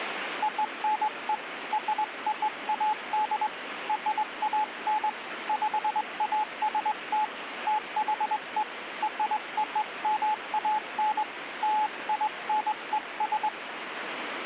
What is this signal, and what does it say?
Morse code (American railroad code), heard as a keyed tone, hand-sent with a straight key, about 860 Hz, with radio static. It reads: ONE ROAD RAN PAST THE ROMAN LINES